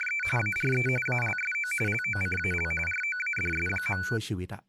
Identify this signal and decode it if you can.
RTTY (45.45 baud, 850 Hz shift), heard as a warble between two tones, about 1900 Hz centre, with speech in Thai. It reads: … ARE ALSO LOCAL ROADS.